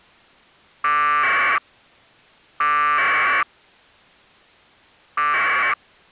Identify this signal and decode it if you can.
Packet radio (AX.25, as in APRS), 1200 baud, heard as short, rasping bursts.